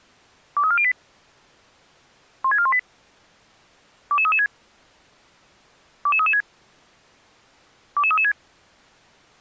Five-tone selective call (ZVEI), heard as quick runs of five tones, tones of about 70 ms. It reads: 23408 16418 22336 22336 22336